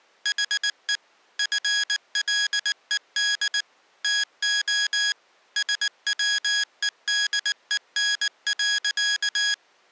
Morse code, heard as electronic beeps, machine-sent, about 19 wpm, 1650 Hz. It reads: HE FLED TO SWEDEN.